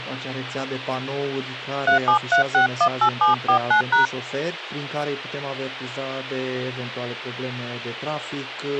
DTMF, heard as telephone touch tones, dialled by hand, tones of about 110 ms. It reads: 373618749#